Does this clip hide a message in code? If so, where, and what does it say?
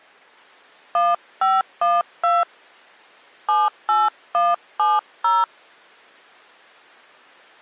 Yes: DTMF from 0.9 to 5.4 s, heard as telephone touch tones, dialled by hand, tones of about 200 ms. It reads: 1512 78170